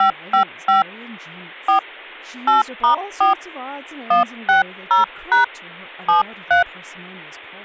DTMF, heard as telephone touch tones, dialled by hand, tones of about 120 ms, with speech in English. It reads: 555 4 8*4 160# 73